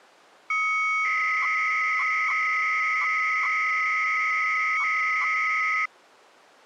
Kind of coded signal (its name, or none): 300-baud modem data